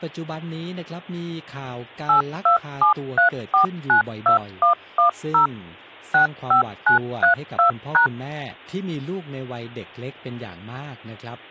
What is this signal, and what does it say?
DTMF, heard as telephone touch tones, dialled by machine, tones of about 110 ms, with speech in Thai. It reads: 8273492110 65932#